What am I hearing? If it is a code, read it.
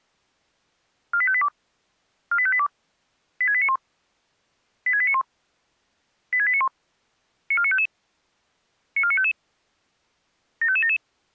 Five-tone selective call (ZVEI), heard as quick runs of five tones, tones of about 70 ms. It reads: 48582 48582 86891 86891 86891 94955 94955 75577